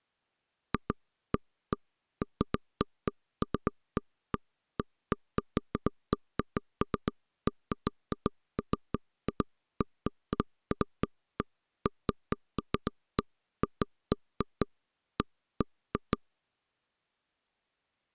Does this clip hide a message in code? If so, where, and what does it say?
No, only irregular taps on a table.